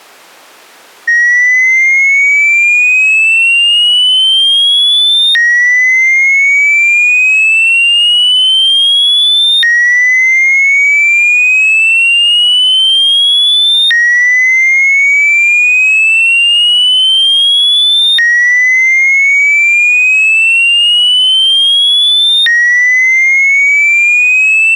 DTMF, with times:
none

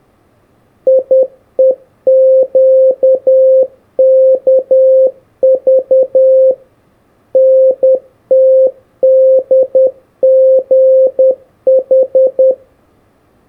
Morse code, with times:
0.9-6.5 IEQKV
7.3-12.5 NTDGH

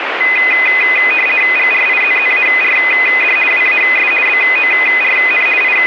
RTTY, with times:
1.6-3.4 GRIZZARD
3.5-4.1 WAS
4.3-5.5 BORN
5.6-5.9 …

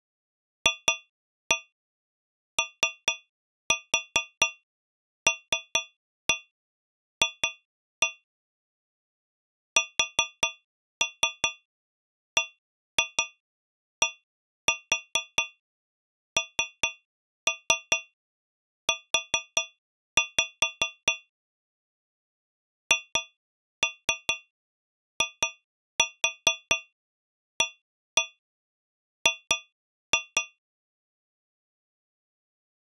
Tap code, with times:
0.7-8.1 FOLF
9.8-21.1 SBDNU
22.9-30.4 HIAG

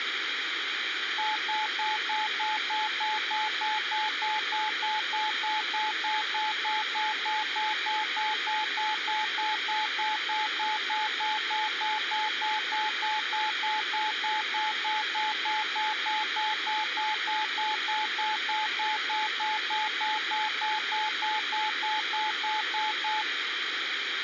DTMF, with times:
none

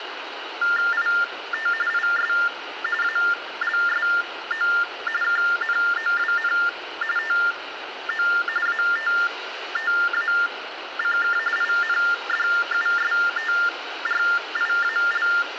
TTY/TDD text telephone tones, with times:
0.9-1.7 IT
1.9-2.3 IS
3.0-4.7 ALSO
5.2-6.5 KNOWN
7.2-8.3 TO
8.7-11.4 ATTACK
11.6-15.3 INDUSTRIAL

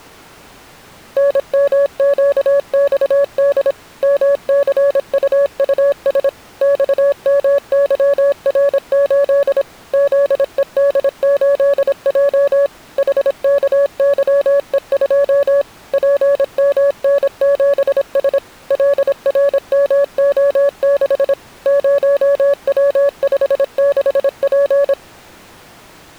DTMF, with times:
none

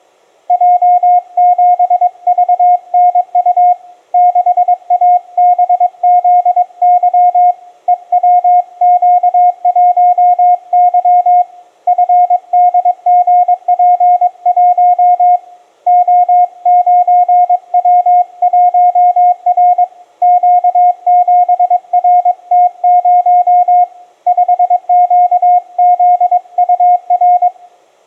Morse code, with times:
0.5-3.7 J7VNU
4.1-7.5 6ABZY
7.9-11.4 EWQ1Y
11.9-15.4 FDGP1
15.9-19.8 O9W1R
20.2-23.8 Q7RT0
24.3-27.5 5QZUR

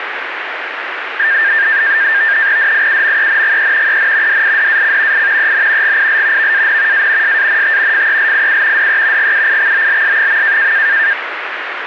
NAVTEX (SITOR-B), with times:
2.6-4.0 DIUMENGE
3.9-4.4 EN
4.3-5.3 DIDAC
5.1-5.5 I
5.4-6.0 EN
5.8-6.5 GIL
6.4-7.1 VAN
6.9-7.4 A
7.2-8.1 SANT
7.9-8.9 FELIU
8.8-9.3 DE
9.2-10.7 GUIXOLS.

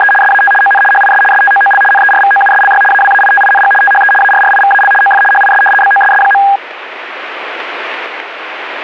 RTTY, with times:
0.0-0.1 …
0.2-0.5 SAT
0.6-0.8 ON
0.9-1.2 HIS
1.3-1.8 STOOL
1.9-2.8 NERVOUSLY
2.9-3.7 AWAITING
3.8-4.1 THE
4.2-4.9 ARRIVAL
5.0-5.2 OF
5.3-5.6 HIS
5.8-6.4 BOSS.

